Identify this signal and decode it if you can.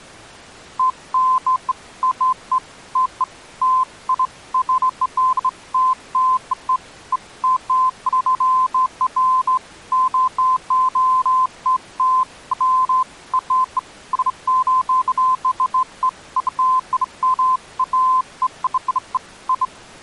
Beeps of irregular length. There is no code.